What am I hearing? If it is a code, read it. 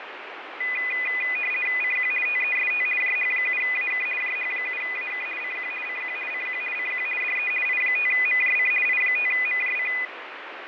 RTTY (50 baud, 450 Hz shift), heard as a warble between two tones, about 2250 Hz centre, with radio static and fading. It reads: CQ TEST JH7AK JH7AK CQ CQ CQ CQ DE I5MJC I5MJC